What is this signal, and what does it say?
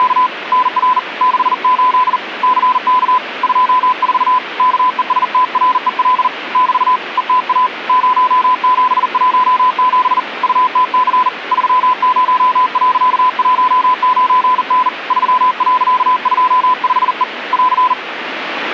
Morse code, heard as a keyed tone, hand-sent with a bug key, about 40 wpm, 1010 Hz, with radio static. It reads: … NR 68 CK 24 KESTREL <BT> ETA 0717 UTC 30.19N 3.25E <AR>